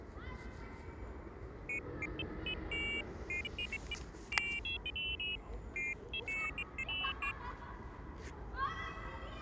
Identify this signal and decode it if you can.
Pairs of high tones at irregular times, with the noise of a residential street. There is no code.